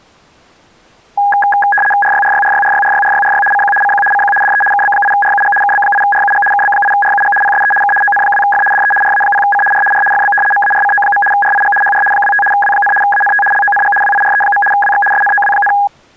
RTTY (75 baud, 850 Hz shift), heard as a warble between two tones, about 1240 Hz centre. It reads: RYRYRYRYRYRYRY CQ CQ CQ DE KB8RUG KB8RUG KB8RUG PSE K ON2F DE RA0C R R FB MARCO. RIG HR 25 W, ANT LONG WIRE. WX SNOW,